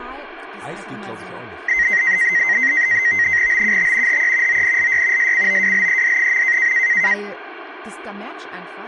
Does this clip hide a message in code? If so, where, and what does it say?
Yes: NAVTEX (SITOR-B), 100 baud, 170 Hz shift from 1.7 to 7.1 s, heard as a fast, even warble, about 2000 Hz centre, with speech in German. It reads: BUT HE ONLY SCOWLED.